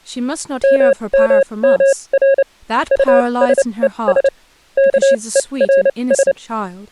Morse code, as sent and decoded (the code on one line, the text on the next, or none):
-- -- -- .-. / ..- ... . ... / -.- . .-. ...
MMMR USES KERS